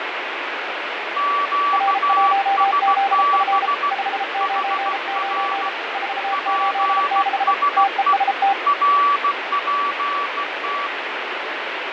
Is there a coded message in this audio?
Yes: Morse code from 1.1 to 10.9 s, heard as two keyed tones, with heavy radio static and fading. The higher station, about 16 wpm, 1150 Hz: QSB HR PSE RPT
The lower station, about 33 wpm, 790 Hz: R1ZF 599 486 TEST